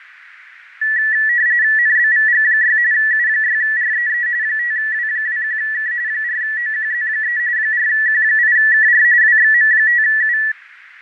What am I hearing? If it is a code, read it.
RTTY (45.45 baud, 170 Hz shift), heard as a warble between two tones, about 1850 Hz centre, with radio static, fading and a narrow filter. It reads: NBVG6 U6REE 5W21K 4OQZ3 4Q8KR WXM5U